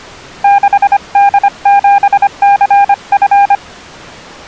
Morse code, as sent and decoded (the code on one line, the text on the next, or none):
-.... -.. --... -.-. ..-.
6D7CF